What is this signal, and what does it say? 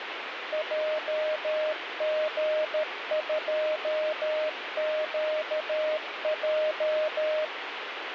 Morse code, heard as a keyed tone, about 13 wpm, 620 Hz, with radio static. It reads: JG2QJ